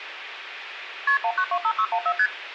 Multi-frequency trunk signalling (R1, as on North American trunks), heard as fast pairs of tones, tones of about 70 ms, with phone line noise. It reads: KP 1925614 ST